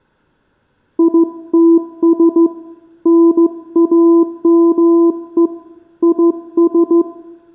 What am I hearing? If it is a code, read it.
Morse code, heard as a keyed tone, hand-sent with a straight key, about 15 wpm, 340 Hz, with room echo. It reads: ITS NAME IS